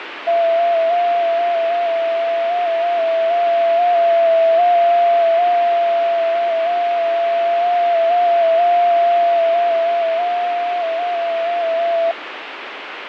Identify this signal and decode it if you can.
FT8 (one signal), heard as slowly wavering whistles, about 6.25 baud, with radio static.